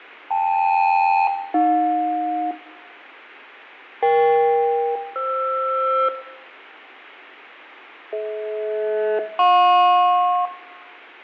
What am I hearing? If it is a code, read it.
Aircraft SELCAL, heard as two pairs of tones, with radio static, fading and room echo. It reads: KL-AJ EK-FR DH-JP